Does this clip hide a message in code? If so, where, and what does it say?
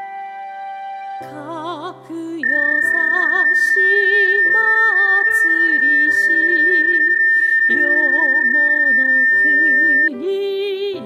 Yes: PSK31 (31.25 baud) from 2.4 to 10.1 s, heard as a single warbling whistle, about 1800 Hz.